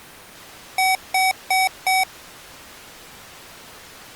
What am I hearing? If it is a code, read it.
Beep code, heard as beeps from a small speaker, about 760 Hz. 4 short. In AMI BIOS tables: system timer failure; in Dell tables: memory read or write failure.